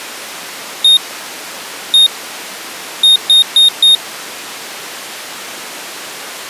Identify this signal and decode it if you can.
Beep code, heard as a piezo beeper, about 3700 Hz. 1-1-4. In Phoenix BIOS tables: BIOS ROM checksum failure.